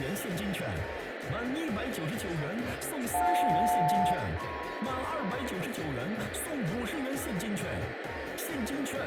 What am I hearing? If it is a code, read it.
Aircraft SELCAL, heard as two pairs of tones, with radio static, a steady whistle near 1750 Hz and room echo. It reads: JL-MP